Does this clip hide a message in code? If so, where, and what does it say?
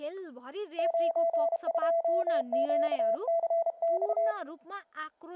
Yes: Morse code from 0.7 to 4.4 s, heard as a keyed tone, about 32 wpm, 670 Hz, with speech in Nepali. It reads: 92QCX